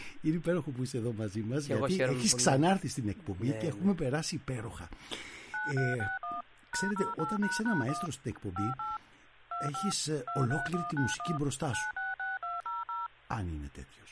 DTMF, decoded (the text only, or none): 9361 #08##1 58 25 23191 966200